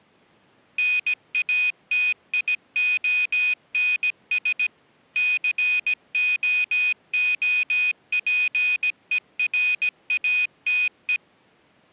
Morse code, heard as a high beeper, machine-sent, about 17 wpm, 2500 Hz. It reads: NATIONS COOPERATE